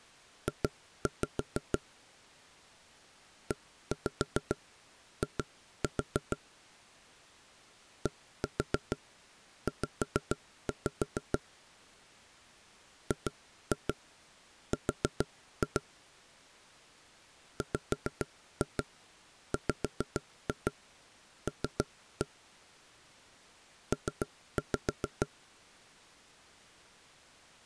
Tap code, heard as knocks on wood, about 6 knocks a second. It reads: J EI DZ GR WWL P